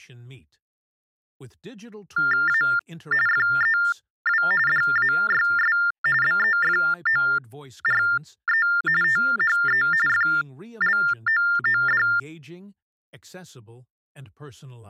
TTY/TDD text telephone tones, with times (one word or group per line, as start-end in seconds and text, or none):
2.5-2.6 A
3.3-4.4 FEW
4.7-5.8 DAYS
6.2-8.7 BEFORE
9.0-9.8 THE
10.1-12.0 FLOOD